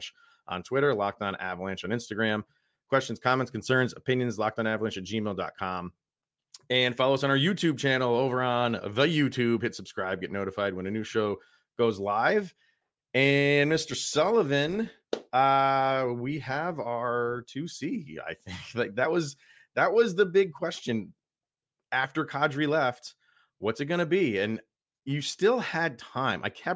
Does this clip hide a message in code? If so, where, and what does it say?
No, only speech in English.